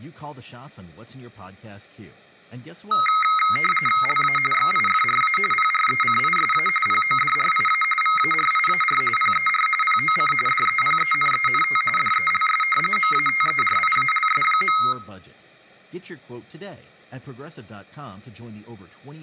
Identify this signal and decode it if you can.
RTTY (45.45 baud, 850 Hz shift), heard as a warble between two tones, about 1700 Hz centre, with speech in English. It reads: LA XIFRA PRECISA PODRIA VARIAR PER POC DEPENENT DELS MATERIALS.